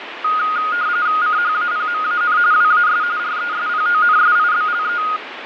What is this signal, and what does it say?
RTTY (45.45 baud, 170 Hz shift), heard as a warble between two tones, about 1340 Hz centre, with radio static and fading. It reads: CHAPMAN WAS RESPONSIBLE